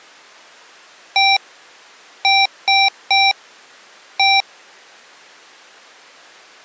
Beep code, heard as beeps from a small speaker, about 780 Hz. 1-3-1. In Phoenix BIOS tables: memory refresh failure.